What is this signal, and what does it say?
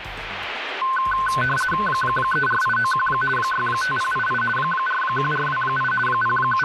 RTTY (50 baud, 450 Hz shift), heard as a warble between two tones, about 1280 Hz centre, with radio static. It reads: 34891 65088 41428 …